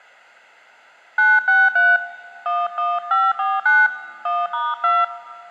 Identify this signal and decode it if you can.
DTMF, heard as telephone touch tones, dialled by hand, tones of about 210 ms, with room echo. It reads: 963 11549 1*2